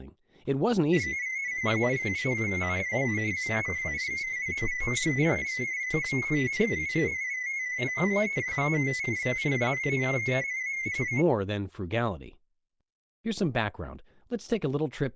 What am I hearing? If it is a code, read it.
Multi-tone FSK (Olivia or MFSK type), about 250 Hz wide, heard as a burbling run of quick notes, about 31.25 baud, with speech in English.